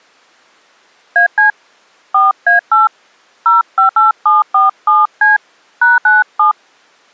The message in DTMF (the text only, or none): AC 4A8 058747C #97